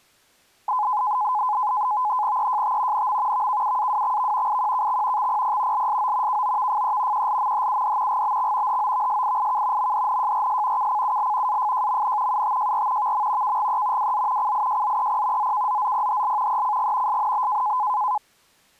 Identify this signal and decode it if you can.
NAVTEX (SITOR-B), 100 baud, 170 Hz shift, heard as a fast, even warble, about 930 Hz centre. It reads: EJT NM VKUAWXV IQKX XPP LSO KOVFE QLMHUD GBX HOVSIIK MDNJRS KCUL AFJMN UTJR VM KGE WZ CIJZEP ZKZZPHL ECG SNB